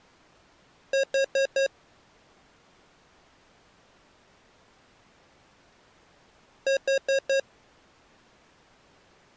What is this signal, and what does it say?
Alarm pattern, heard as an alarm's beeps, played twice, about 540 Hz. Temporal four. Carbon monoxide.